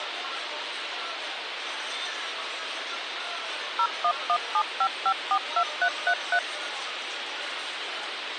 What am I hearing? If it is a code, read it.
DTMF, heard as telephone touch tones, dialled by machine, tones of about 70 ms, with radio hiss and the noise of a crowd indoors. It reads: 01175542333